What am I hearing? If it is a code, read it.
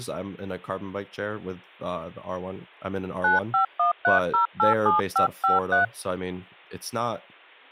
DTMF, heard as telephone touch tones, dialled by hand, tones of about 140 ms, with speech in English. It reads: 9513087553